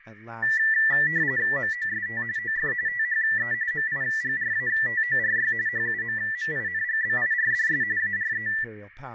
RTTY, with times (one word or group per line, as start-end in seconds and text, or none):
1.6-2.2 MOST
2.4-2.7 OF
2.9-3.5 THE
3.7-5.5 MIGRATORY
5.7-7.8 HUMMINGBIRDS
8.0-8.5 ARE